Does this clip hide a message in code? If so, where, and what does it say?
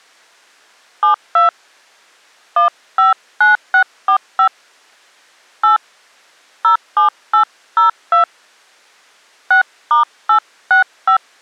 Yes: DTMF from 1.0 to 11.2 s, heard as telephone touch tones, dialled by hand, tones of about 110 ms. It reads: 72 159645 8 07802 6*865